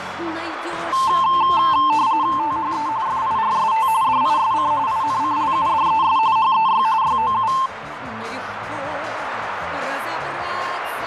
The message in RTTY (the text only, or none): THE FIRST DISC INCLUDES HEY YOU